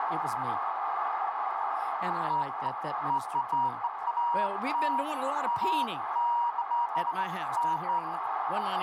Beeps of irregular length, with radio static, a narrow filter and speech in English. There is no code.